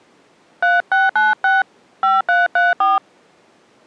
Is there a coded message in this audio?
Yes: DTMF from 0.6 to 3.0 s, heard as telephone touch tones, dialled by hand, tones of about 180 ms. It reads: 3696 5334